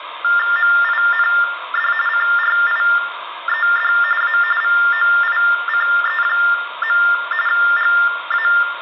TTY/TDD text telephone tones (45.45 baud Baudot), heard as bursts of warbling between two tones, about 400 Hz shift, 1600 Hz centre, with phone line noise and room echo. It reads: MIND CRIED A VOICE. GA